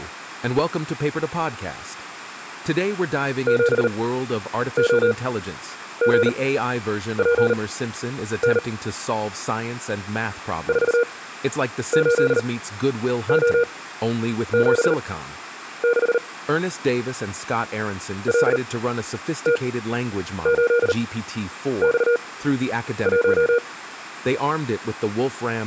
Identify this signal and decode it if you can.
Morse code, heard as a keyed tone, machine-sent, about 39 wpm, spaced as for 9 wpm, 480 Hz, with speech in English. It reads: 7OGPN 48O76 LT8X1